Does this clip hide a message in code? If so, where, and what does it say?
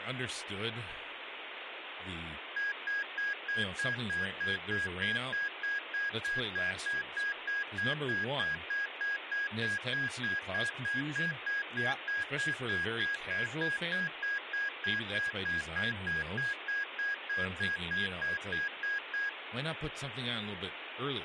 No, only evenly repeated beeps, with phone line noise and speech in English.